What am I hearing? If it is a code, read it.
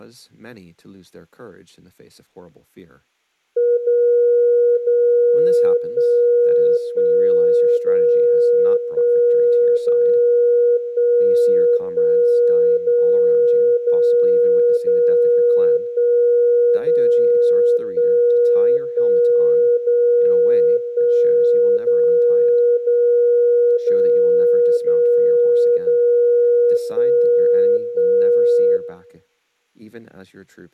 Radio time signal (DCF77), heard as a tone whose level steps once a second, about 480 Hz, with room echo and speech in English. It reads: 0 0 1 1 0 1 0 1 1 0 0 0 1 0 1 1 0 1 0 0 0 0 0 1 1